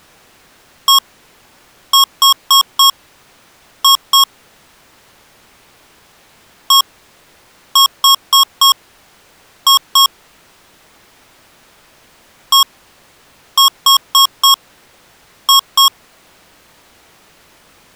Beep code, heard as beeps from a small speaker, played three times, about 1090 Hz. 1-4-2. In Phoenix BIOS tables: parity failure in the first 64 KB of memory.